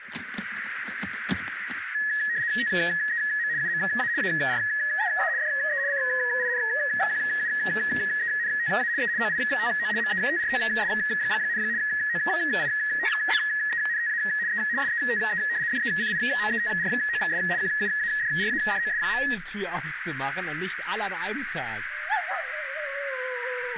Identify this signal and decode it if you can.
RTTY (75 baud, 170 Hz shift), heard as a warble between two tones, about 1800 Hz centre, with radio static and a narrow filter. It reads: TEM UMA AREA DE CINQUENTA E OITO METROS, OITENTA E SETE DECIMETROS QUADRADOS.